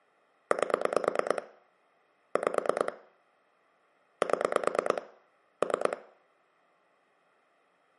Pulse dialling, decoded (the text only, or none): 8 5 7 3